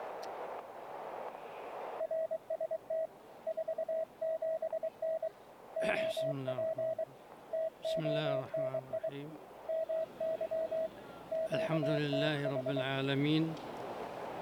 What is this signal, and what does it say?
Morse code, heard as a keyed tone, hand-sent with a paddle, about 23 wpm, 640 Hz, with static crashes. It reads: RST 47N OP TONI MY QTH